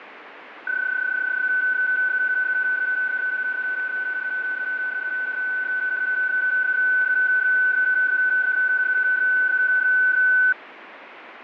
PSK31 (31.25 baud), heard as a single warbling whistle, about 1500 Hz, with radio static and fading.